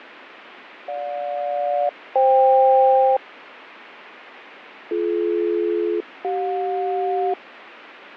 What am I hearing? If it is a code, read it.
Aircraft SELCAL, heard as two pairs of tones, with radio static and fading. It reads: GJ-FK BD-CJ